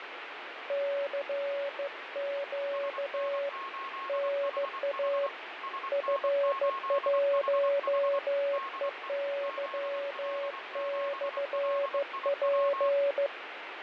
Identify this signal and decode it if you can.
Morse code, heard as two keyed tones, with radio static and fading. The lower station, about 15 wpm, 560 Hz: CQ NA F1EY/P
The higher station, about 24 wpm, 1080 Hz: SN8HH SN8HH DE ZL7LIW